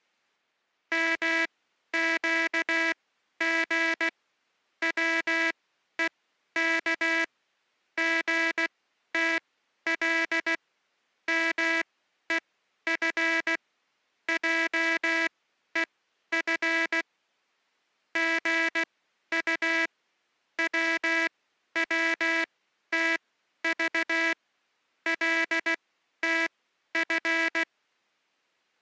Morse code (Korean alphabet), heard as a buzzer, machine-sent, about 16 wpm, spaced as for 11 wpm. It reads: 맷방석만한 시뻘건